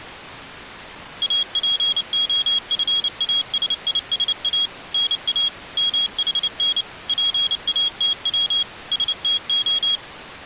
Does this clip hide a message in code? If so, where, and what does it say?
Yes: Morse code (Greek alphabet) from 1.2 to 10.0 s, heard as a high beeper, machine-sent, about 29 wpm, 3300 Hz. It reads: ΑΠΟΦΑΣΙΣΑ ΝΑ ΜΗΝ ΠΑΤΩ ΣΤΟ